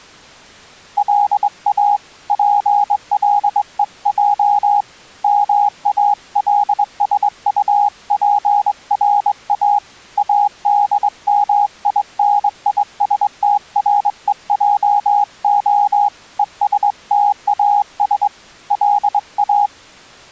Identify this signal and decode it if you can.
Morse code, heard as a keyed tone, hand-sent with a straight key, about 22 wpm, 820 Hz. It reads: LA PLEJ MALSUPRA ADMINISTREJO ESTAS LA